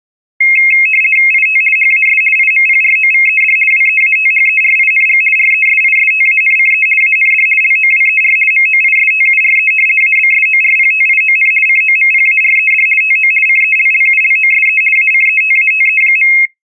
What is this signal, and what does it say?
RTTY (50 baud, 450 Hz shift), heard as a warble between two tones, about 2350 Hz centre. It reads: IT HAS IMPROVED WEATHERING RESISTANCE AND LOWER MOISTURE ABSORPTION COMPARED TO CELLULOSE ACETATE.